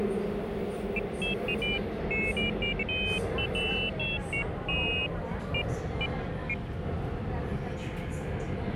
Pairs of high tones at irregular times, with hum and the noise inside a subway train. There is no code.